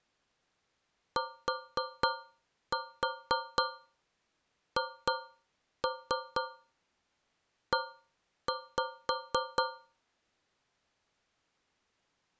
Tap code, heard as taps on a metal pipe, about 4 knocks a second. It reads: THE